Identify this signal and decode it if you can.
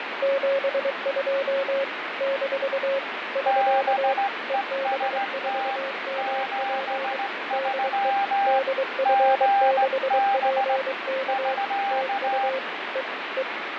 Morse code, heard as two keyed tones, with radio static and fading. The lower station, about 23 wpm, 540 Hz: 72 - <SK> EB4MP DE DF6PK TU E E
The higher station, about 17 wpm, 800 Hz: BEST 73 GB <SK>